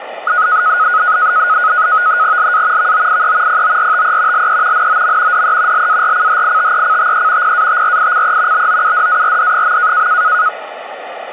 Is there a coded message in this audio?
Yes: NAVTEX (SITOR-B), 100 baud, 170 Hz shift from 0.3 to 10.5 s, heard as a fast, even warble, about 1360 Hz centre, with radio static. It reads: LA VOIE PORTE LE NOM DE LARCHITECTE PATRICE BOUDARD.